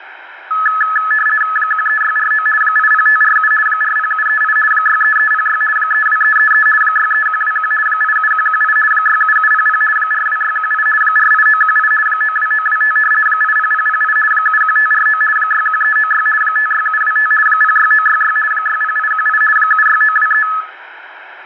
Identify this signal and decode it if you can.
RTTY (50 baud, 450 Hz shift), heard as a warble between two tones, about 1500 Hz centre, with radio static. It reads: 13649 80547 40738 63306 32333 63121 87118 67700 42618 48918 92925 80008 71549 61396 56725 06966 60818 76923